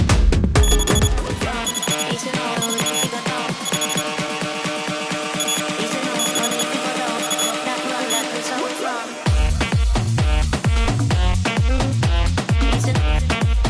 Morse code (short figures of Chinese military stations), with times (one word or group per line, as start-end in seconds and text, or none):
0.6-4.0 6545
5.4-8.2 1620